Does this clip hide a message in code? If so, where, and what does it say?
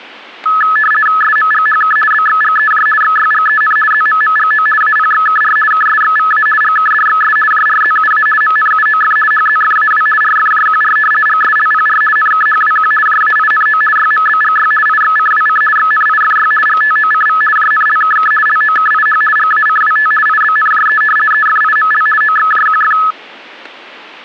Yes: RTTY (50 baud, 450 Hz shift) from 0.5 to 23.1 s, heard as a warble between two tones, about 1500 Hz centre, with static crashes. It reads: SMGHK BXGEJ XYGEN ZMMGO APXKR KSXVA GKDXS JRZUA MNUOF HZFAW RFJQR GSLPR NKHWQ JAINO YMBGY IXCWC XNIFY GTOCV JNLKK LOKIH GACWT IBNJE EFIML OXJQF